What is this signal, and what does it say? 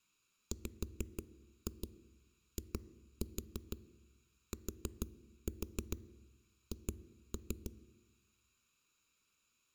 Tap code, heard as knocks on a wall, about 6 knocks a second, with room echo. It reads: WITH